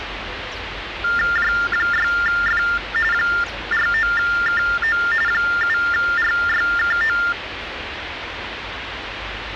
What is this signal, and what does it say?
TTY/TDD text telephone tones (45.45 baud Baudot), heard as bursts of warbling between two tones, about 400 Hz shift, 1600 Hz centre, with phone line noise and the noise of a residential street. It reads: J6F 49KO 7RYKO